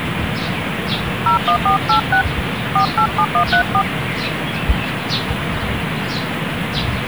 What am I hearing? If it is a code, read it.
DTMF, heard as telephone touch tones, dialled by hand, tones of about 90 ms, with phone line noise and the noise of a park. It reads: 01486 487134